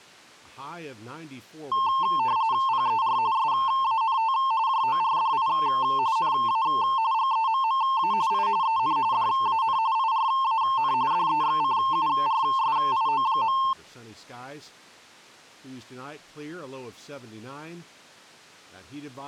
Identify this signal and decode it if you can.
RTTY (45.45 baud, 170 Hz shift), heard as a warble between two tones, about 980 Hz centre, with speech in English. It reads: PER SANT JORDI NA GEMMA I EN DAN IRAN DEXCURSIO.